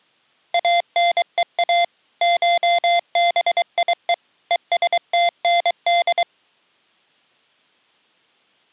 Morse code (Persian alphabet), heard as electronic beeps, machine-sent, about 23 wpm, 690 Hz. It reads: انها شبیه هستند